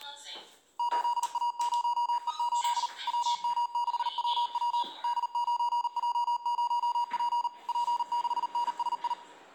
Morse code, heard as electronic beeps, machine-sent, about 39 wpm, 960 Hz, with room echo and the noise inside a lift. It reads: 8A0E8 WM6WW D9J0P P6NSI